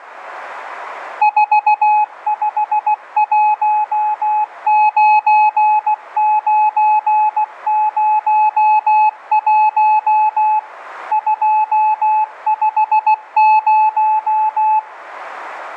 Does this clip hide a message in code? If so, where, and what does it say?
Yes: Morse code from 1.2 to 14.9 s, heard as a keyed tone, machine-sent, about 16 wpm, 860 Hz, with radio static and room echo. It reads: 4519901 250